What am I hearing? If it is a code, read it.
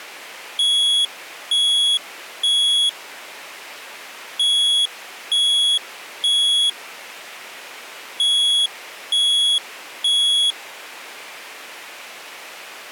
Alarm pattern, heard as an alarm's beeps, played three times, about 3350 Hz. Temporal three. Smoke or fire, evacuate.